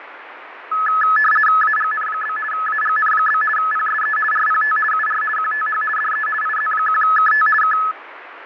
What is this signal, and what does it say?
RTTY (50 baud, 450 Hz shift), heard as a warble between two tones, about 1500 Hz centre, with radio static and fading. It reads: AGN? AGN? PSE RPT UR QTH DE IZ1KT K